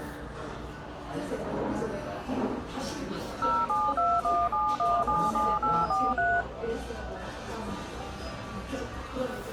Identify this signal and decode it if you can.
DTMF, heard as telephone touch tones, dialled by machine, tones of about 230 ms, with the noise of a cafe. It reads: 07217177843